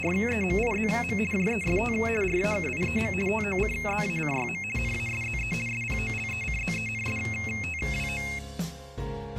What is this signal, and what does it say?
RTTY (50 baud, 450 Hz shift), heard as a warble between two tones, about 2350 Hz centre. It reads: … JEST RAKIEM TOCZACYM NASZE SPOLECZENSTWO